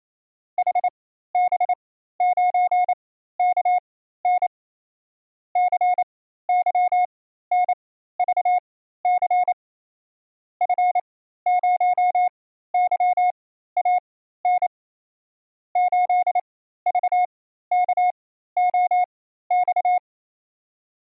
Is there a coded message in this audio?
Yes: Morse code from 0.5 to 20.0 s, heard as a keyed tone, machine-sent, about 28 wpm, spaced as for 14 wpm, 720 Hz. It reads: HB9KN CYNVC F0YAN 8VKOX